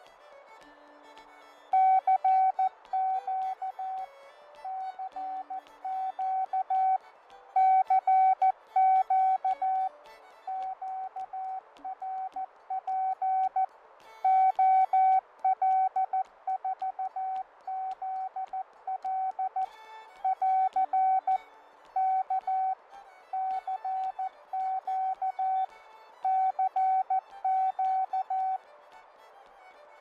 Morse code, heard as a keyed tone, machine-sent, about 14 wpm, 760 Hz, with radio static and fading. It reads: CQ CQ CQ QRP OL4ZL <AR> K CQ CQ